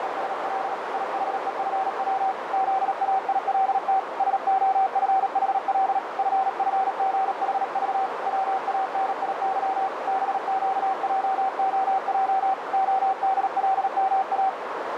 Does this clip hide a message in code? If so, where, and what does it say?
Yes: Morse code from 0.0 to 14.6 s, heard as a keyed tone, hand-sent with a paddle, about 37 wpm, 770 Hz, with heavy radio static and a narrow filter. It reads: … IHEFW ZAILT SOFHL FFGHV WANIY BQJOJ ODLMA